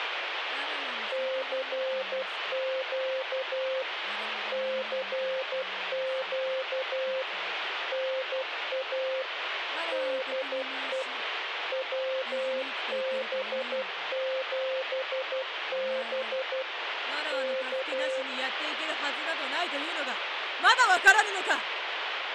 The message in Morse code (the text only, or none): CQ CQ NA DE WB7B K